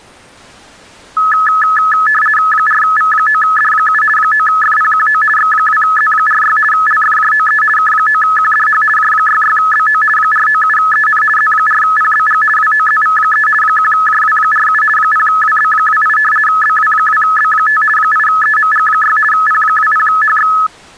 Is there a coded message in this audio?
Yes: RTTY (50 baud, 450 Hz shift) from 1.2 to 20.7 s, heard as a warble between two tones, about 1500 Hz centre. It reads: 4V9D7 9FPQO X2Z46 LFJOE K9QDH J66BO 497EN Z4PBG WOZV3 1JW47 0WB28 BW2B5 8EMG6 P20HX